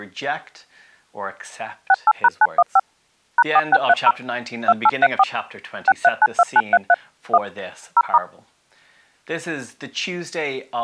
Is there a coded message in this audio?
Yes: DTMF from 1.9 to 8.2 s, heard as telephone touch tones, dialled by machine, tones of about 40 ms. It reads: 68#915 #4630 2834 6392933 1 0*